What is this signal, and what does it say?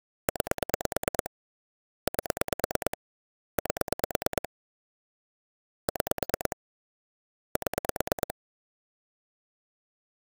Pulse dialling, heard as clicks on a phone line, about 9 pulses a second. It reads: 9 8 8 6 7